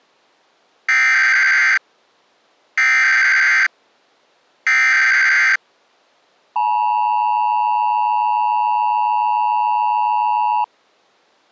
Emergency Alert System (SAME) tones (header bursts, then the 853 and 960 Hz attention tone), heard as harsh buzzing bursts, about 520.83 baud.